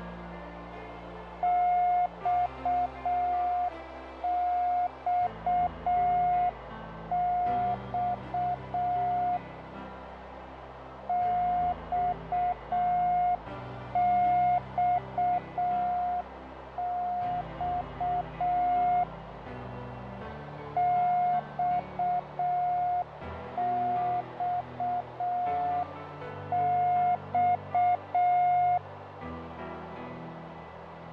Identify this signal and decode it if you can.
Morse code, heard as a keyed tone, hand-sent with a paddle, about 6 wpm, 720 Hz, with radio static, fading and a narrow filter. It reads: XXX XXX XXX